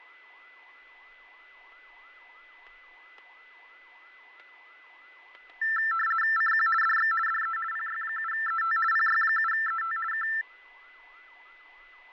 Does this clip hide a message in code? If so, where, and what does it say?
Yes: RTTY (50 baud, 450 Hz shift) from 5.6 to 10.4 s, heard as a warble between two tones, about 1550 Hz centre, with fading, static crashes and a steady whistle near 2010 Hz. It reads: CQ DX DE PY7ET PY7ET K